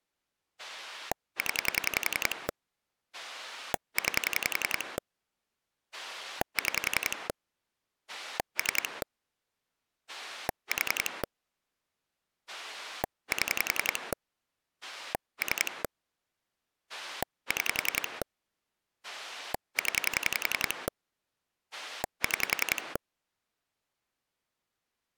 Pulse dialling, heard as a rotary dial, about 10 pulses a second. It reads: 0 9 6 3 4 7 3 6 0 6